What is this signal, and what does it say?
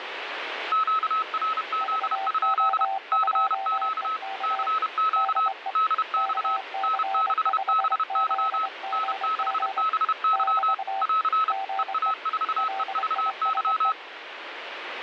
Morse code, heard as two keyed tones, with radio static. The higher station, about 31 wpm, 1290 Hz: QRZ? CQ CQ DX N6BY N6BY <AR> EA4EVY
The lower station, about 23 wpm, 780 Hz: VO2EK DE KC5ZGG <BT> GE LISE